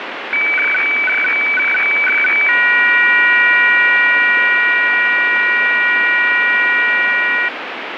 Weather fax (radiofax), 120 lines a minute, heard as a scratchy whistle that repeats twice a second, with radio static.